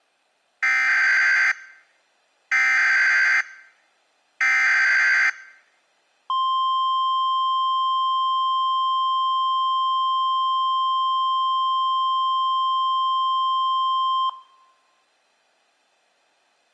Emergency Alert System (SAME) tones (header bursts, then the 1050 Hz attention tone), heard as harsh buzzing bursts, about 520.83 baud.